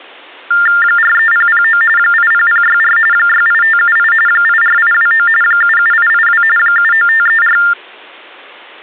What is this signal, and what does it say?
TTY/TDD text telephone tones (45.45 baud Baudot), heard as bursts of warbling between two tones, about 400 Hz shift, 1600 Hz centre. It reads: 43009 80064 68578 84829 77882 79534